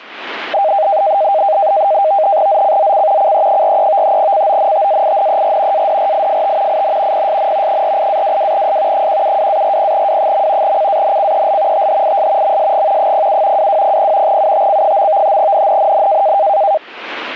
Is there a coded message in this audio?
Yes: NAVTEX (SITOR-B), 100 baud, 170 Hz shift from 0.5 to 16.8 s, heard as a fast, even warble, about 710 Hz centre, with radio static. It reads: ZCZC CE43 CONTAINER ADRIFT IN PSN 48-22S 172-40W. CANCEL THIS MSG 07 2200 UTC. NNNN